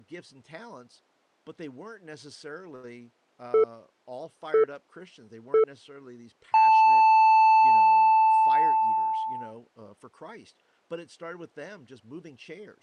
Radio time signal (three low pips and a long one an octave up, as on NHK), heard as pips, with speech in English.